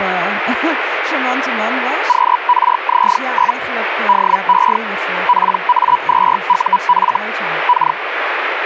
Hellschreiber (Feld-Hell, 122.5 baud), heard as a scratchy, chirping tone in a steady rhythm, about 980 Hz, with radio static and speech in Dutch. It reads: QRZ? DE PA2UF K